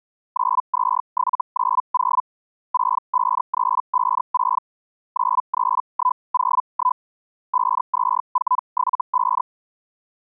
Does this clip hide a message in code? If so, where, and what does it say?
Yes: Hellschreiber (Feld-Hell, 122.5 baud) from 0.3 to 9.4 s, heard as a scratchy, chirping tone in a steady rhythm, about 1000 Hz. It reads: 92790 65356 93101 52475